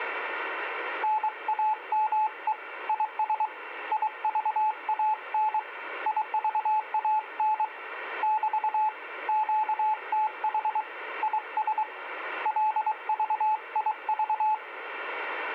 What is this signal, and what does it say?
Morse code, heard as a keyed tone, hand-sent with a paddle, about 23 wpm, 860 Hz, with radio static. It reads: NAME IS IVAN IVAN <BT> QTH IS LVIV